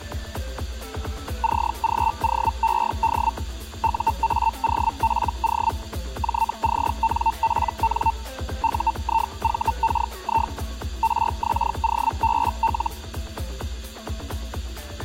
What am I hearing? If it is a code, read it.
Hellschreiber (Feld-Hell, 122.5 baud), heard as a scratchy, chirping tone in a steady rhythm, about 900 Hz. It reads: CGOED UAOPO JCNPN UIVKI RXOBL